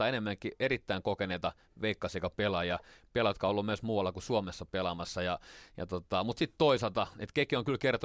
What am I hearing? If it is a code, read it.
Speech in Finnish. There is no code.